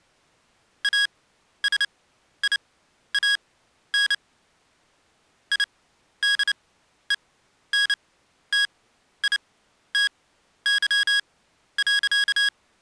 Morse code, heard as electronic beeps, machine-sent, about 29 wpm, spaced as for 12 wpm, 1650 Hz. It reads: ASIAN IDENTITY.